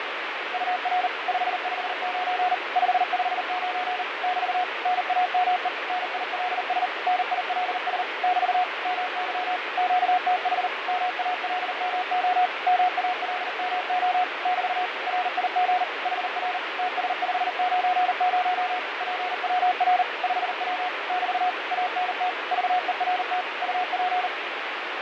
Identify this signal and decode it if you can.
Morse code, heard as a keyed tone, machine-sent, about 39 wpm, 730 Hz, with heavy radio static and fading. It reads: UR 559 559 <BT> NAME NILS NILS <BT> MY QTH MALMO MALMO <BT> RIG HR TS590 PWR 5W <BT> ANT VERT UP